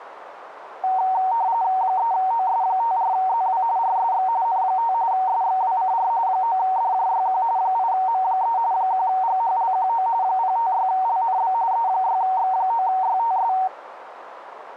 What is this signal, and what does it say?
RTTY (45.45 baud, 170 Hz shift), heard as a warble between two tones, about 840 Hz centre, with radio static. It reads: 3OS54ZW RSX N5 SXWCR 9DJYQ 8M3 1GHLQO 056LNB E6X9YTS